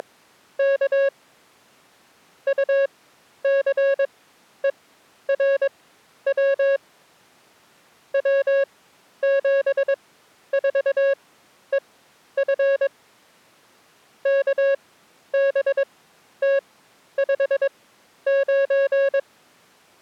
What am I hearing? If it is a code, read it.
Morse code, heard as a keyed tone, machine-sent, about 22 wpm, spaced as for 11 wpm, 550 Hz. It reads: … UCERW W74EF KBT59